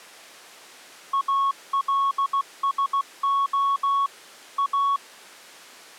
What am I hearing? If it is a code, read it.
Morse code, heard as a keyed tone, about 16 wpm, 1110 Hz. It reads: ALSO A